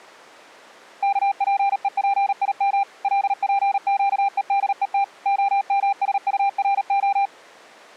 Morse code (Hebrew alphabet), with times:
1.0-2.8 כפופים
3.0-5.0 לפקודות
5.3-7.3 המשטרה

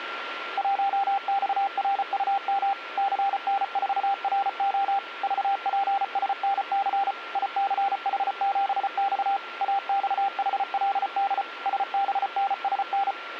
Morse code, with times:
0.6-2.7 1XRUM
3.0-5.0 CN4RO
5.2-7.1 VPSNC
7.4-9.4 ICH7X
9.6-11.4 AXHLD
11.7-13.1 SBNSN

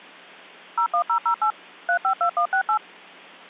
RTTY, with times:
none

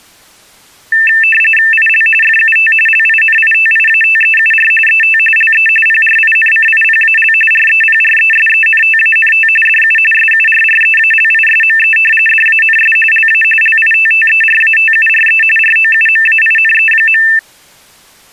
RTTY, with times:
1.7-2.1 IL
2.2-2.7 FUT
2.9-4.7 LINITIATEUR
4.9-5.2 ET
5.4-5.7 LE
5.9-7.3 PRINCIPAL
7.5-9.5 REPRESENTANT
9.7-10.0 DU
10.1-12.0 SURREALISME
12.3-13.0 DANS
13.1-13.4 LA
13.6-15.4 LITTERATURE
15.6-17.2 ROUMAINE.

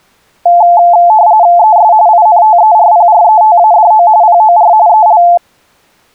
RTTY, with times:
1.6-1.9 ES
2.1-4.1 INTERPRETADO
4.2-4.7 POR
4.9-5.2 EL

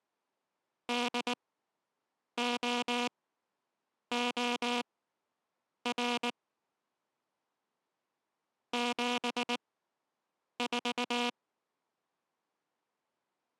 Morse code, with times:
0.9-6.3 DOOR
8.7-11.3 74

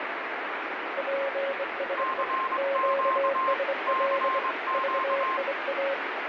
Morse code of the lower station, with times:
1.0-2.2 PSE
2.6-4.4 QSL
4.7-5.9 VIA

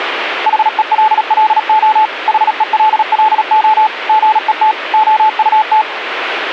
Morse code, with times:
0.5-2.1 HELLO
2.3-3.9 HELLO
4.1-4.7 GET
4.9-5.8 OUT

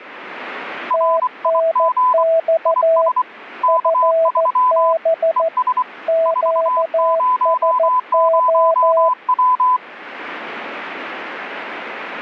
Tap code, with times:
none

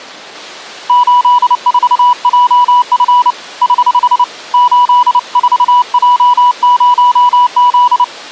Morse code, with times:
0.9-3.3 84JF
3.6-4.2 <HH>
4.5-8.0 84J0Z

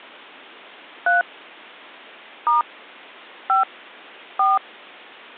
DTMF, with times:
1.1-1.2 3
2.5-2.6 *
3.5-3.6 5
4.4-4.6 4

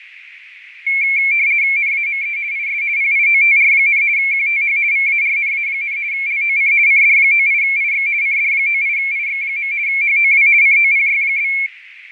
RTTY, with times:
1.8-2.4 NAME
2.5-2.8 IS
3.0-4.0 PIOTR,
4.2-4.8 QTH
4.9-6.0 VARNA,
6.1-6.7 LOC
6.9-8.1 CD98IX
8.2-9.7 CD98IX.
9.9-10.5 HOW
10.6-11.5 COPY?

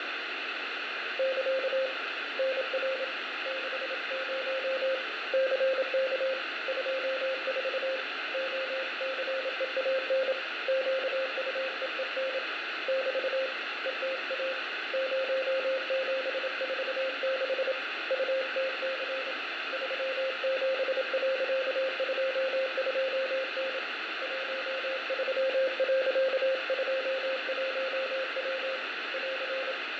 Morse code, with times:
1.2-1.9 <KA>
2.4-3.0 NR
3.5-4.9 60
5.3-6.3 CK
6.7-8.0 24
8.3-10.3 OCEAN
10.7-12.4 QUEEN
12.9-13.5 <BT>
13.9-14.5 ETA
14.9-17.7 0746
18.1-19.3 UTC
19.7-23.8 37.22N
24.2-28.8 13.21W
29.1-29.7 <AR>

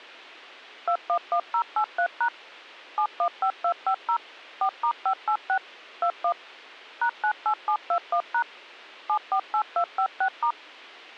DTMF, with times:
0.9-2.3 211083#
3.0-4.2 715250
4.6-5.6 4*586
6.0-6.3 21
7.0-8.4 #98721#
9.1-10.5 748256*

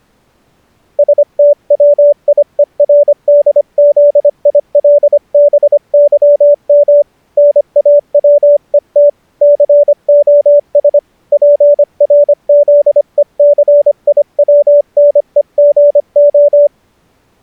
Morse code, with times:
1.0-7.0 STWIERDZILBYM
7.4-9.1 NAWET
9.4-11.0 COS
11.3-16.7 PRZECIWNEGO

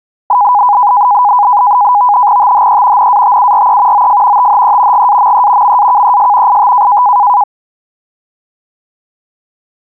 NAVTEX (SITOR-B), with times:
2.4-3.1 THE
3.0-4.1 NATURE
3.9-4.5 OF
4.4-5.1 THE
4.9-5.8 GAME
5.6-6.6 MAKES
6.5-7.0 IT

